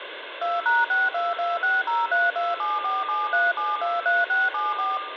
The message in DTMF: 2#62260327473723674

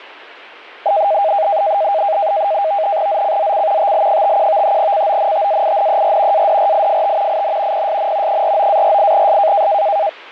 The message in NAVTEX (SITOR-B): ZCZC TL51 CONTAINER ADRIFT IN PSN 49-48S

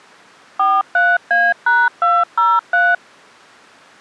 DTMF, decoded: 43A#203

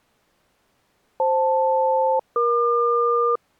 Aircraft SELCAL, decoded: FL-EQ

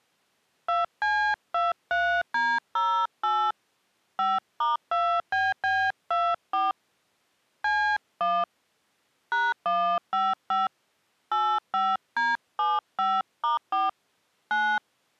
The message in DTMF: 2C23D08 5*2BB24 C1 #155 85D75*4 9

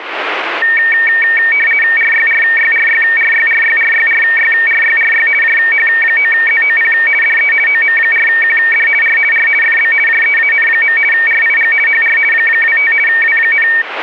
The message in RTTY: RYRYRYRYRYRYRYRYRY JH9ZOP DE OM4QD R R FB JEAN. RIG HR 25 W,

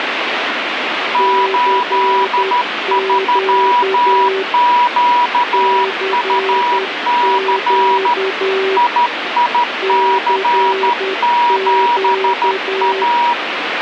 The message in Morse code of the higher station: 83QUC IIC7A

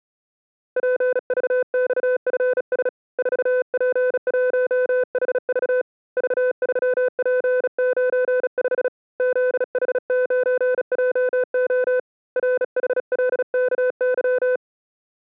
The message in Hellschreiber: none

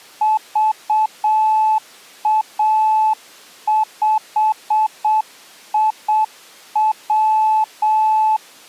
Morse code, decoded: VA5IW

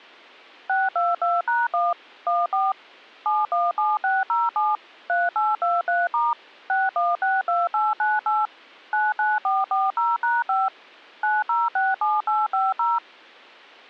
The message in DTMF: 622#1 14 717607 3823* 6162898 99440#5 9067850

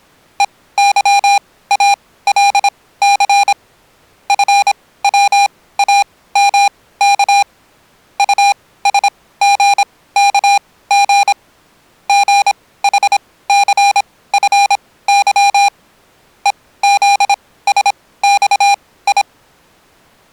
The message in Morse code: EYALC FWAMK USGKG GHCFY EZSXI

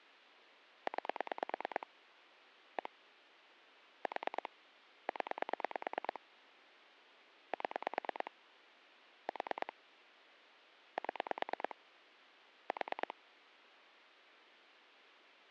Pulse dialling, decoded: 9 1 4 0 7 4 7 4

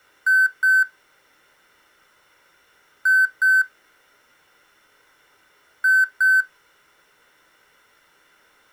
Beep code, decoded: 2 short

